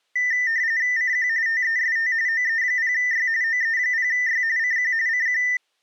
RTTY (45.45 baud, 170 Hz shift), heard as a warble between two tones, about 1900 Hz centre. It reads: CQ TEST OE0Y OE0Y CQ CQ